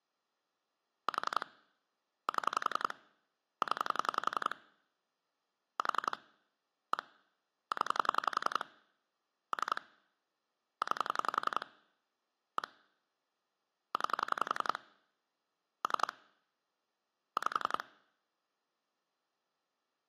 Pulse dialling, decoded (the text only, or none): 4 7 0 4 1 0 3 9 1 9 3 5